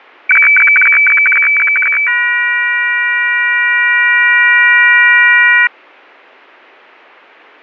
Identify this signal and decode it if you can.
Weather fax (radiofax), 120 lines a minute, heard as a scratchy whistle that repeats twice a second.